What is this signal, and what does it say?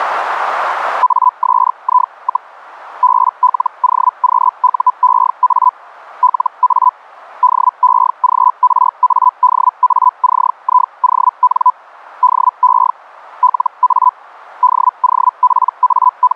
Hellschreiber (Feld-Hell, 122.5 baud), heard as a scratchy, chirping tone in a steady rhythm, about 1000 Hz. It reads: ASI, BLOQUEA LA DEGRADACION DE LA …